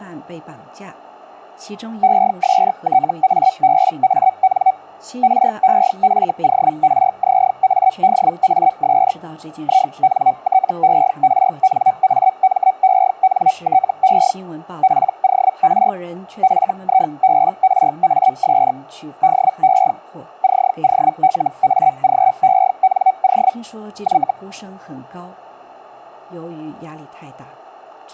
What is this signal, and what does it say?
Hellschreiber (Feld-Hell, 122.5 baud), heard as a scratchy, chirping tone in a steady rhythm, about 760 Hz. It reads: ESTABAN REFORZADAS INTERNAMENTE POR FIBRAS DE COLAGENO Y